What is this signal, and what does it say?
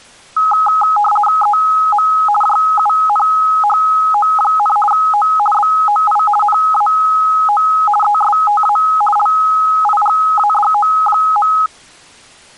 RTTY (50 baud, 450 Hz shift), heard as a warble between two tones, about 1050 Hz centre. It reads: EM JUNHO, O BOI NAO ESTA LIGADO.